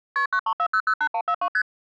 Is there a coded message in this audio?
Yes: multi-frequency trunk signalling (R1, as on North American trunks) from 0.2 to 1.6 s, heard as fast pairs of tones, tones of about 70 ms. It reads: KP 934008142 ST